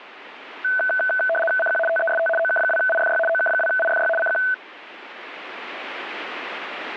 RTTY (75 baud, 850 Hz shift), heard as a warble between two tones, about 1090 Hz centre, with radio static. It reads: CQ TEST OK2IFY OK2IFY CQ